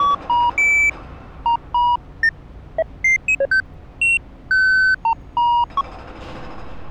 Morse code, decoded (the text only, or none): none